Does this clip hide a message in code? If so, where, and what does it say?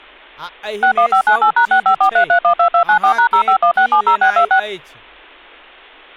Yes: DTMF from 0.8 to 4.6 s, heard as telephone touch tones, dialled by machine, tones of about 90 ms, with speech in Maithili. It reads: 61598#6543312294#051670626